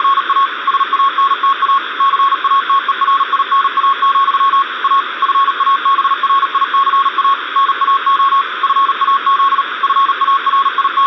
Morse code, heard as a keyed tone, machine-sent, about 38 wpm, 1100 Hz, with radio static. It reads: … SANTA CATERINA, A FABRICA NAO FAZ …